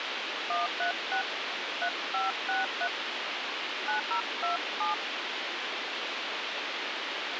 DTMF, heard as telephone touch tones, dialled by hand, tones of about 120 ms, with radio hiss. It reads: 136 3563 9027